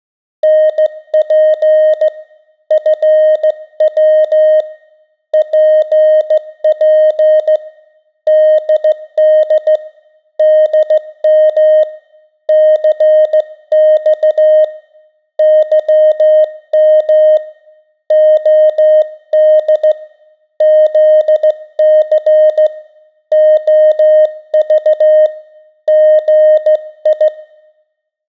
Morse code, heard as a keyed tone, hand-sent with a straight key, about 15 wpm, 620 Hz. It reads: NP FW PP DD DM CX YM OD ZC OV GI